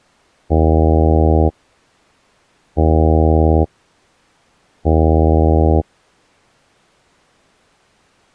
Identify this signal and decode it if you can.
Ship horn signal, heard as a ship's horn, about 80 Hz. 3 short. At sea: I am operating astern propulsion.